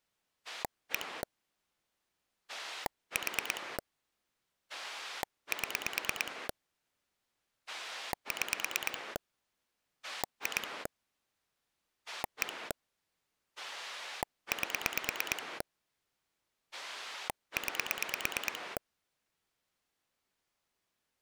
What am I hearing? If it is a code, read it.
Pulse dialling, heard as a rotary dial, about 9 pulses a second. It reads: 1 4 7 6 2 1 8 9